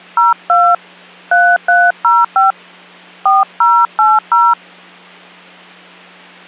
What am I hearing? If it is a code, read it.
DTMF, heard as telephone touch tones, dialled by hand, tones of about 190 ms, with hum. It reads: 02 3305 4080